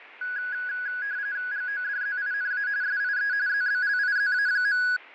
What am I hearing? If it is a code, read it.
RTTY (45.45 baud, 170 Hz shift), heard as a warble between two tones, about 1550 Hz centre, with fading. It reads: GODZINA SIE ZBLIZA.